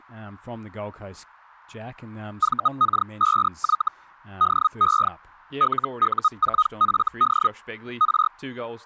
Hellschreiber (Feld-Hell, 122.5 baud), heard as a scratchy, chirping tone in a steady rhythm, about 1250 Hz, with speech in English. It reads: VK5Y DE LU4FD R